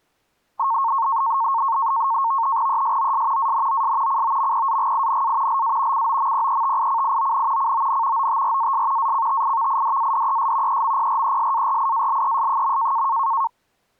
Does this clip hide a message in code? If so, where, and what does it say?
Yes: NAVTEX (SITOR-B), 100 baud, 170 Hz shift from 0.6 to 13.5 s, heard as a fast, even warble, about 1000 Hz centre. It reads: ESOS ANOS COMPAGINA LA COMPETICION CON OTRAS ACTIVIDADES EMPRESARIALES.